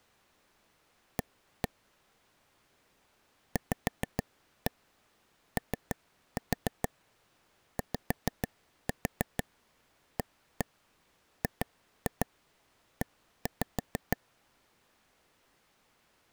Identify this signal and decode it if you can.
Tap code, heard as taps on a table, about 6 knocks a second. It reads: A VOYAGE